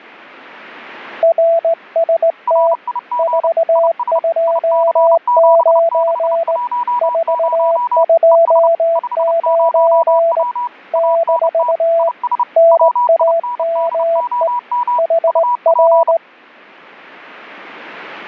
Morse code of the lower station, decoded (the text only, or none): RST 429 429 - NAME HR